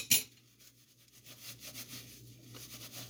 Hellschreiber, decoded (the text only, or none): none